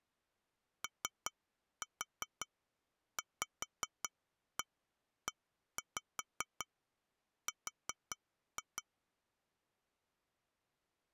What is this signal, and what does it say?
Tap code, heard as taps on glass, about 5 knocks a second. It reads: OVER